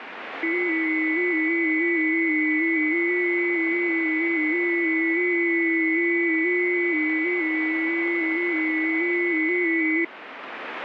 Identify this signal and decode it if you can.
FT8 (several signals at once), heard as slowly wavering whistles, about 6.25 baud, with radio static.